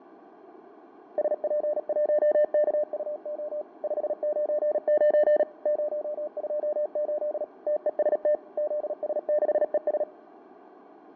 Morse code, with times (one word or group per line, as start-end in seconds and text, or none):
1.2-3.6 SP1KUO
3.8-5.4 599
5.7-7.4 028
7.7-8.3 TEST
8.6-10.0 ZS6ES